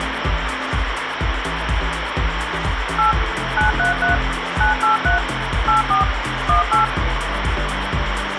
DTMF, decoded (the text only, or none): 8 933 983 84 18